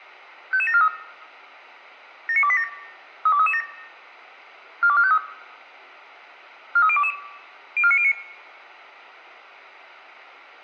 Five-tone selective call (ZVEI), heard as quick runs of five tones, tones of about 70 ms, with room echo. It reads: 55743 79287 32337 42453 43022 04909